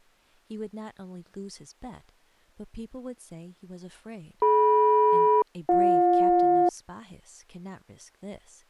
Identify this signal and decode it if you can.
Aircraft SELCAL, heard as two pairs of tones, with speech in English. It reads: DM-BJ